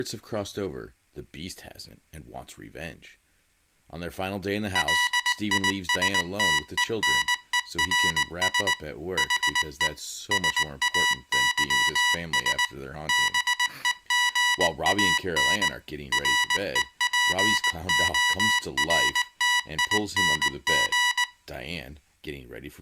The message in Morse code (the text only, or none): LISTENERS HE SAYS BEGAN REPORTING